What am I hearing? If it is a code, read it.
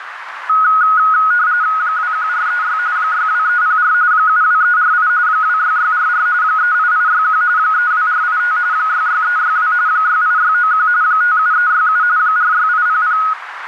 RTTY (45.45 baud, 170 Hz shift), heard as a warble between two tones, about 1360 Hz centre, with radio static and a narrow filter. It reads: 21436 62304 72348 26644 38861 32485 66362 68691 57367 46800